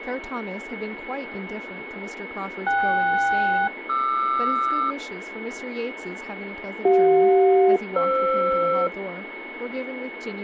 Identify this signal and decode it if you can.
Aircraft SELCAL, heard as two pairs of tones, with radio static, a steady whistle near 2200 Hz and speech in English. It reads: KS-QR CJ-FR